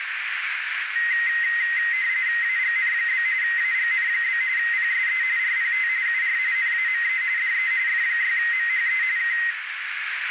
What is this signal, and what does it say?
RTTY (45.45 baud, 170 Hz shift), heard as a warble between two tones, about 1950 Hz centre, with radio static and a narrow filter. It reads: AGN? AGN? PSE RPT UR NAME DE F6MHE K